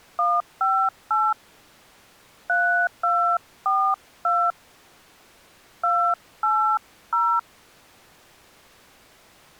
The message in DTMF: 158 3242 280

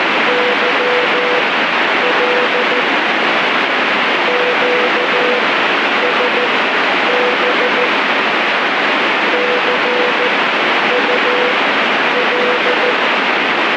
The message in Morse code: YL QSB CUL

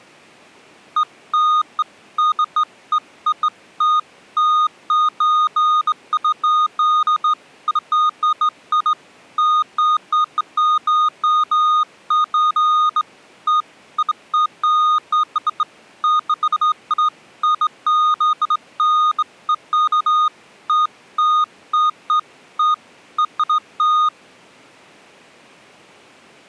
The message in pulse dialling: none

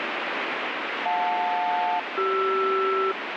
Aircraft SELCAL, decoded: JL-CR

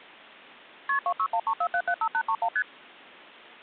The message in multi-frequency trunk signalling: KP 26134775831 ST

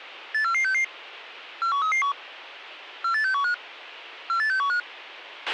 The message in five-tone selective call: 84466 41331 48615 48615

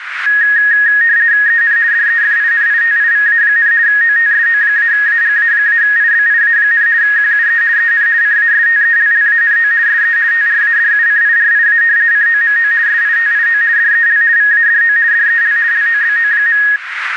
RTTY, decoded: EN DEFINITIVA, OTSO-AGA-IBIA, QUE EN CASTELLANO SE TRADUCIRIA COMO SITIO DEL VADO DEL LOBO.

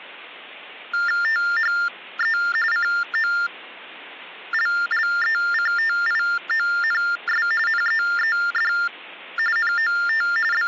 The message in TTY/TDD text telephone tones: THE COLLECTIONS NEED NOT …

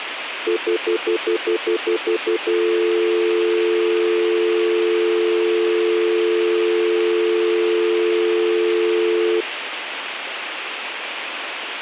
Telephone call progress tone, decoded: stutter dial tone

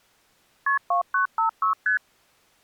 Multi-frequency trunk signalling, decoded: KP 2956 ST

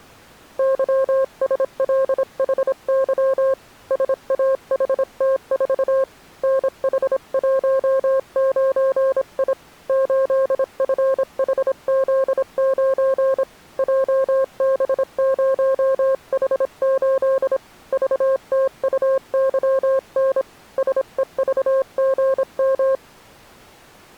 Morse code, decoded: YSLHY SAHT4 NH19I 8FHZ9 JB0H8 VTUYN SEVGM

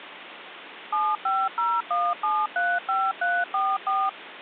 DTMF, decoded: 7501735344

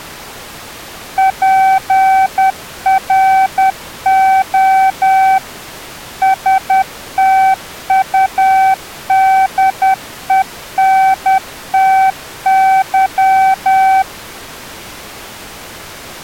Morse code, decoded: PRO STUDENTY

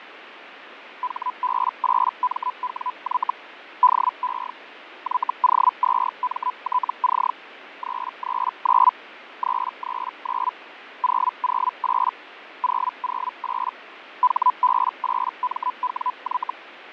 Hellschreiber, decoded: HB8MWY DE YO2MTC 339 339 008 008 HB8MWY

